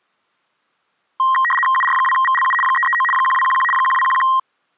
RTTY (75 baud, 850 Hz shift), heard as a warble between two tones, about 1480 Hz centre. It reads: UR2VLU 339 1211 1211